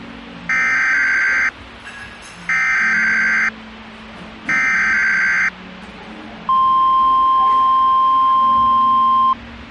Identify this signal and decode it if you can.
Emergency Alert System (SAME) tones (header bursts, then the 1050 Hz attention tone), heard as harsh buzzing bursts, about 520.83 baud, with the noise of a cafe.